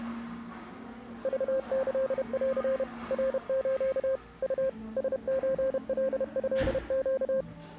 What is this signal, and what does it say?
Morse code (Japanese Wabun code), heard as a keyed tone, machine-sent, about 31 wpm, 530 Hz, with the noise of a cafe. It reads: クキン ナス ウ ラソカトネ